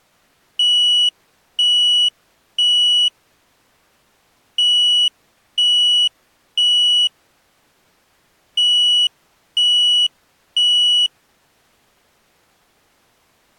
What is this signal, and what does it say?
Alarm pattern, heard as an alarm's beeps, played three times, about 2950 Hz. Temporal three. Smoke or fire, evacuate.